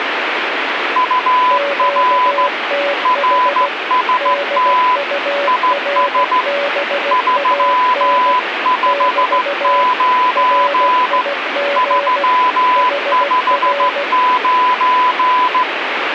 Morse code, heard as two keyed tones, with radio static. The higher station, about 15 wpm, 1000 Hz: UR RST IS 359 359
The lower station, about 16 wpm, 570 Hz: QTH DURBAN <BT> RIG HR